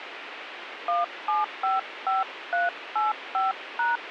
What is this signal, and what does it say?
DTMF, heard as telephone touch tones, dialled by hand, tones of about 160 ms, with radio hiss. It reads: 1755385#